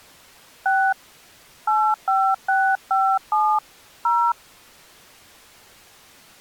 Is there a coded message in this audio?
Yes: DTMF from 0.7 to 4.3 s, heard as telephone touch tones, dialled by hand, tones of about 270 ms. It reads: 6 85657 0